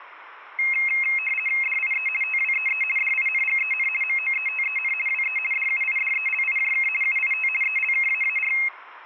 RTTY (50 baud, 450 Hz shift), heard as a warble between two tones, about 2350 Hz centre, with room echo. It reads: DIE TWEE DINGEN MOETEN WE DUIDELIJK UIT ELKAAR